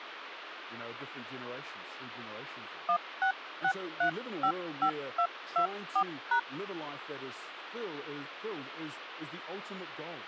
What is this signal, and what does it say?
DTMF, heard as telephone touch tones, dialled by hand, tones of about 80 ms, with phone line noise and speech in English. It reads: 166355224#